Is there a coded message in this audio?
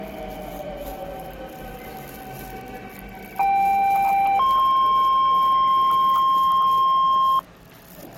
Yes: two-tone page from 3.4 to 7.4 s, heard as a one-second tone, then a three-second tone, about 790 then 1060 Hz, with the noise of a subway station.